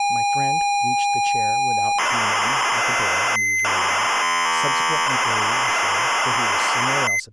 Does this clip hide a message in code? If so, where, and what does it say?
Yes: ZX Spectrum tape loading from 0.0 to 7.2 s, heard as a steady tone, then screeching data, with speech in English.